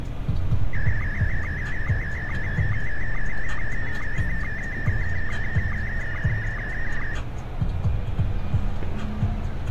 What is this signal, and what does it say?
SSTV (slow-scan television), Scottie S1, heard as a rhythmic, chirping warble, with street noise.